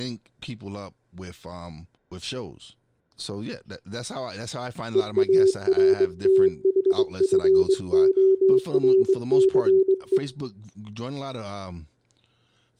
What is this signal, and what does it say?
Morse code, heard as a keyed tone, hand-sent with a straight key, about 22 wpm, 380 Hz, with room echo and speech in English. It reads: EARTHFORCE